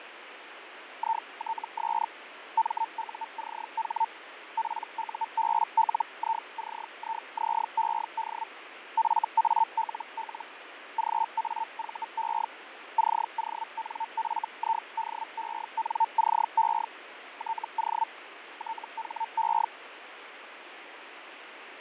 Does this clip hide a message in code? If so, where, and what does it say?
Yes: Hellschreiber (Feld-Hell, 122.5 baud) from 1.0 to 19.7 s, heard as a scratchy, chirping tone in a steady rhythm, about 900 Hz, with radio static and fading. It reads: ITS MUCH PUBLICIZED FALL GAVE CONFIDENCE TO THE